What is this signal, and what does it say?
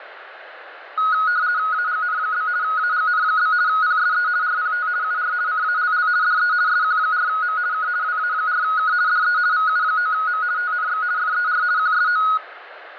RTTY (50 baud, 170 Hz shift), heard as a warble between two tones, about 1360 Hz centre, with radio static. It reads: AGN? AGN? PSE RPT UR CALL DE SQ4M K WA4K DE VU9M TNX FER QSO